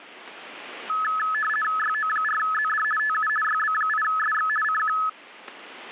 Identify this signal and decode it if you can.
RTTY (50 baud, 450 Hz shift), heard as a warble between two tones, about 1500 Hz centre. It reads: YO4ZD TU YB8SX CQ